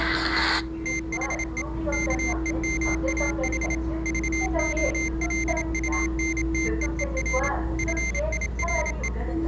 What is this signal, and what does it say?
Morse code, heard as a high beeper, machine-sent, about 27 wpm, 2100 Hz, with the noise inside a subway train. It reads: THE KEMAH VOLUNTEER FIRE